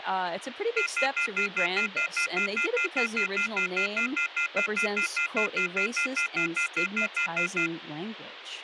Telephone call progress tone (North American plan), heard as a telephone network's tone, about 1400, 2050, 2450, 2600 Hz, 0.1 s on and 0.1 s off, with phone line noise and speech in English. Off-hook warning tone.